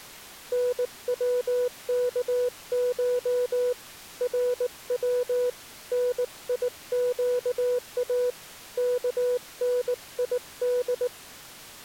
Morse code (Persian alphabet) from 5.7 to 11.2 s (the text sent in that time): نیگا کنید